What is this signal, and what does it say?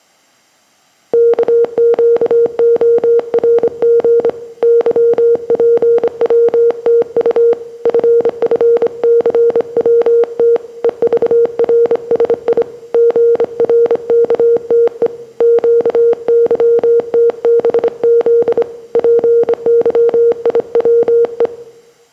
Morse code, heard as a keyed tone, hand-sent with a straight key, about 25 wpm, 470 Hz, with room echo. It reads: KQORG YPWTU FFCWT EVRSI GRKTE QYTBZ PYIWE